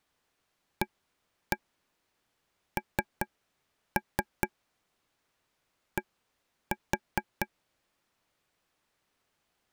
Tap code, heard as taps on a table, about 4 knocks a second. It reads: AND